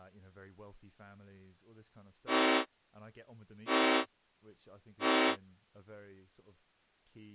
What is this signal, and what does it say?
Train horn signal, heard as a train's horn, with speech in English. 3 short. On North American railways: when stopped, the train will back up.